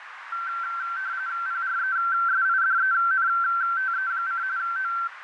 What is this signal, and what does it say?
RTTY (45.45 baud, 170 Hz shift), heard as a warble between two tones, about 1450 Hz centre, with radio static and a narrow filter. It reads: PRESIDENTE: O